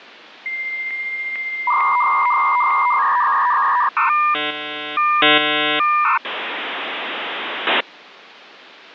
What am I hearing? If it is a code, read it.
Dial-up modem handshake (V.34 or later), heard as a whistle, warbles, then hiss.